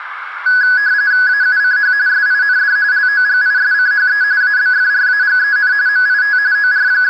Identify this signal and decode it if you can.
RTTY (45.45 baud, 170 Hz shift), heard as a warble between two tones, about 1600 Hz centre, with radio static and a narrow filter. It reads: AUCH SIND LOGISCHE ABFRAGEN MIT …